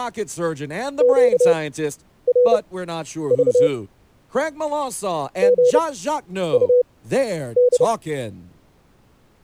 Morse code, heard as a keyed tone, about 30 wpm, spaced as for 10 wpm, 490 Hz, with speech in English. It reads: QRV GUD